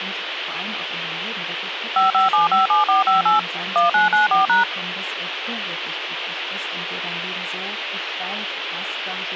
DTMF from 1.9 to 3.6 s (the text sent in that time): 55757458